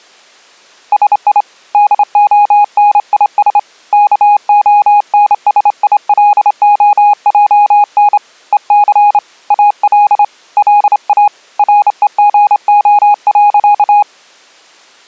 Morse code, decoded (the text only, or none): SI DONIS KONSILOJN EC AL LA REGO.